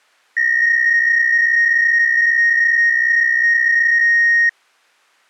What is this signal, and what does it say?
PSK63 (62.5 baud), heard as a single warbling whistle, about 1850 Hz.